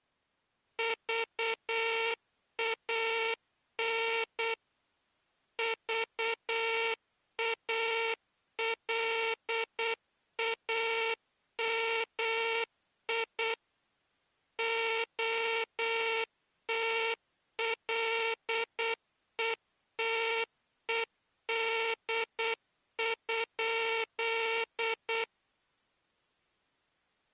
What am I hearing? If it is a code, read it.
Morse code, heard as a buzzer, machine-sent, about 8 wpm. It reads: VAN VALAMI OTLETED?